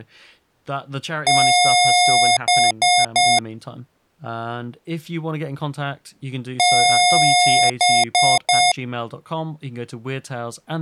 Beep code, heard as beeps from a small speaker, played twice, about 720 Hz, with speech in English. 1 long, 3 short. In Award and IBM BIOS tables: video adapter failure; in AMI BIOS tables: memory failure.